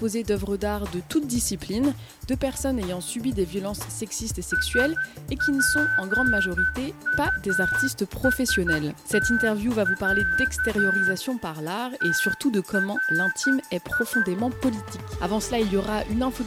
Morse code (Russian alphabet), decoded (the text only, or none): СПУСТЯ ТРИ